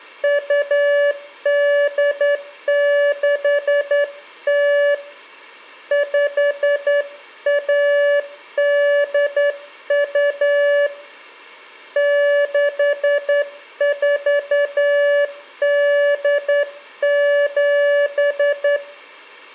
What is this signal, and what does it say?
Morse code (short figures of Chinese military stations), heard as a keyed tone, hand-sent with a straight key, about 10 wpm, 580 Hz, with room echo. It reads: 2860 5182 6487